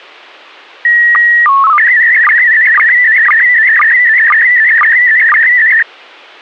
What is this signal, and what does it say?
SSTV (slow-scan television), PD 120, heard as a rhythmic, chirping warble.